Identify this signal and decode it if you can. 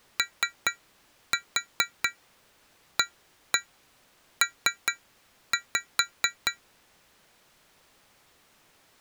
Tap code, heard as taps on glass, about 4 knocks a second. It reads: OAP